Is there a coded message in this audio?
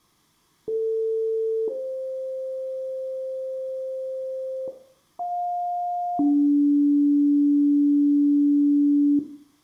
Yes: two-tone page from 0.7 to 9.2 s, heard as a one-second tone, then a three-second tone, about 450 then 520 Hz, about 710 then 290 Hz, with room echo.